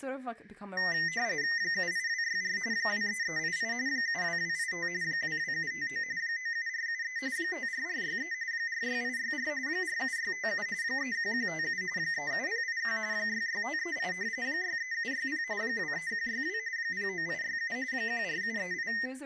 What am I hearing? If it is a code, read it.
RTTY (45.45 baud, 170 Hz shift), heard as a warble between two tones, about 1950 Hz centre, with speech in English. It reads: 78264 23388 72285 22759 97473 54463 46864 47657 31157 37081 66538 63760 23162 09867 14738